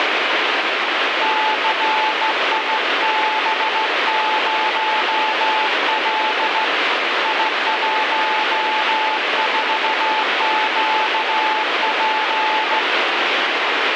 Morse code, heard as a keyed tone, hand-sent with a straight key, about 16 wpm, 870 Hz, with heavy radio static. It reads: CIB0L I14QP